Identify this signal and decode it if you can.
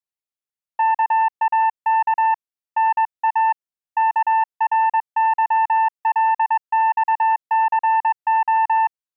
Morse code (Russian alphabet), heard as a keyed tone, hand-sent with a straight key, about 21 wpm, 890 Hz. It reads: КАК НА КРЫЛЬЦО